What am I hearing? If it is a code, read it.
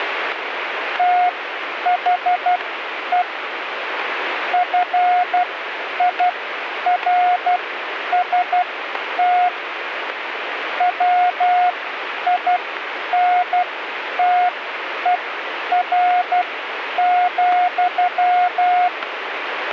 Morse code, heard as a keyed tone, machine-sent, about 12 wpm, spaced as for 9 wpm, 720 Hz, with radio static. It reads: THE FIRST WINTER,